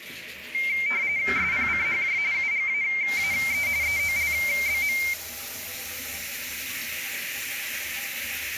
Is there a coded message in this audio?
Yes: RTTY (45.45 baud, 170 Hz shift) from 0.5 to 5.1 s, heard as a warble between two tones, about 2200 Hz centre, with radio static and the noise of a restroom. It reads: SPCHJ UGAAE EOLBM